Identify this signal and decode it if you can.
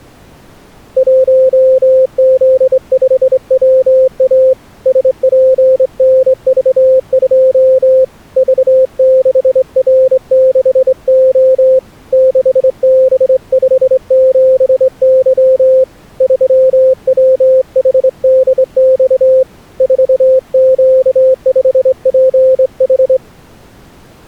Morse code, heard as a keyed tone, hand-sent with a straight key, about 24 wpm, 520 Hz. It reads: 1Z5WA SPNV2 V6R6O 6B57Y 3WHDX 4Q5PH